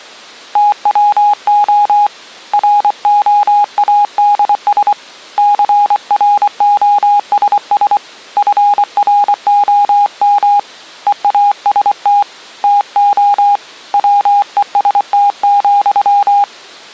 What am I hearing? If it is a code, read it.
Morse code, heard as a keyed tone, hand-sent with a paddle, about 24 wpm, 820 Hz. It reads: TWO ROADS CROSS FROM EAST TO WEST,